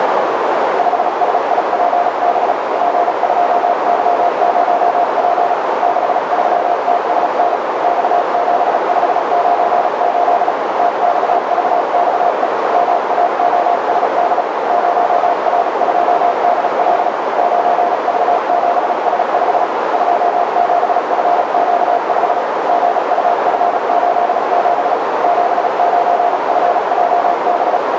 Morse code, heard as a keyed tone, machine-sent, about 36 wpm, spaced as for 33 wpm, 700 Hz, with heavy radio static and a narrow filter. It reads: 5SIPB G2Y0P 63TSN X7598 TXVXE MAOSD 0R2DL 9V7S5 27FQ5 GUF87 79FJB